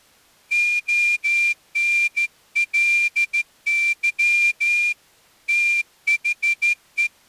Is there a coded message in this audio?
Yes: Morse code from 0.5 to 7.1 s, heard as a whistle, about 14 wpm. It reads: ONLY THE